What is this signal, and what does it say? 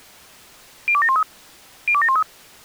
Five-tone selective call (ZVEI), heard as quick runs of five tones, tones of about 70 ms. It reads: 02713 02713